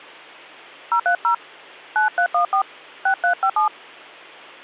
DTMF, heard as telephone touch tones, dialled by hand, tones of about 100 ms, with hum. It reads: 030 9314 6357